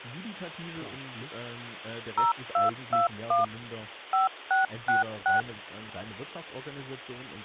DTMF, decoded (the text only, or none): 0221 5666